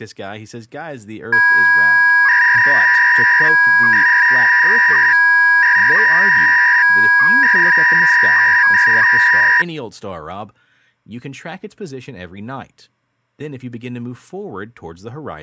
300-baud modem data (V.21 tones), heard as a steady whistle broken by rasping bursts, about 300 baud, 200 Hz shift, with speech in English.